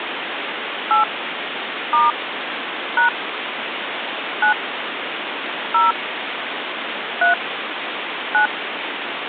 DTMF, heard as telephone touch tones, dialled by hand, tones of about 130 ms, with phone line noise. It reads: 8 * # 9 0 3 9